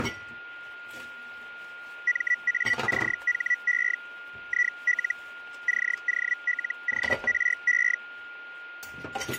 Hellschreiber (Feld-Hell, 122.5 baud), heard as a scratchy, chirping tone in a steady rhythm, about 1950 Hz, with a steady whistle near 1420 Hz and kitchen noise. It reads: MACHE IL COLORE